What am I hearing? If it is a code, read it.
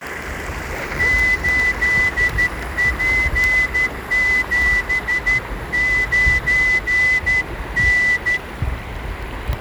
Morse code, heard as a whistle, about 12 wpm, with the noise of a park. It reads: 8P79N